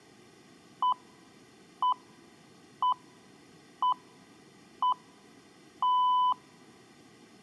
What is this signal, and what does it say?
Radio time signal (six pips, as the Greenwich Time Signal), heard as pips, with room echo.